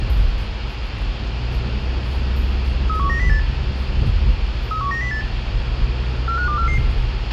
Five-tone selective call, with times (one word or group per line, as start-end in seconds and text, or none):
2.9-3.4 31908
4.7-5.2 31908
6.3-6.8 45244